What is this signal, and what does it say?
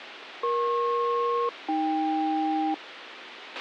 Aircraft SELCAL, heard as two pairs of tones, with radio hiss and a squelch burst at the end. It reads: EP-AK